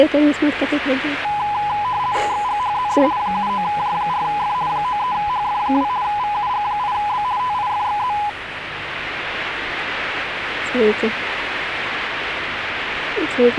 RTTY (50 baud, 170 Hz shift), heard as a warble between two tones, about 920 Hz centre, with radio static. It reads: XGHZD 79J4F 93HF2 VUG8B TIFXZ